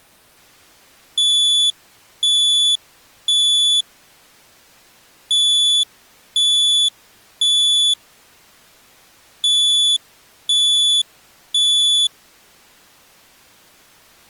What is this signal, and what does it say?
Alarm pattern, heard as an alarm's beeps, played three times, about 3450 Hz. Temporal three. Smoke or fire, evacuate.